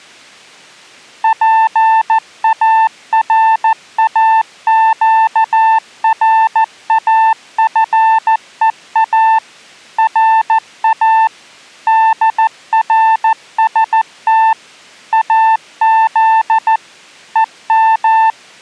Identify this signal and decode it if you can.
Morse code (Persian alphabet), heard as a keyed tone, machine-sent, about 14 wpm, 890 Hz. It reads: پاراگرافها را درست از هم